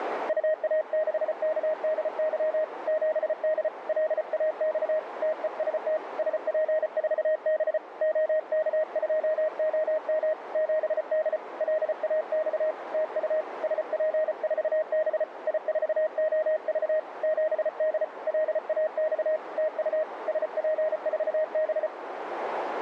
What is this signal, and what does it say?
Morse code, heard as a keyed tone, hand-sent with a paddle, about 34 wpm, 620 Hz, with radio static and a narrow filter. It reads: UA6KDY 7D LAX TEST SP4B OK2OM 7D LAX TU SP4B I4OV 7D LAX TU SP4B